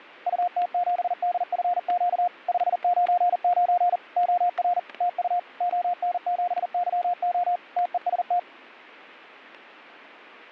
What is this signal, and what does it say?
Morse code, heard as a keyed tone, machine-sent, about 40 wpm, 710 Hz, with static crashes. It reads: UT7DFQ 599 OR TU ON7YO TEST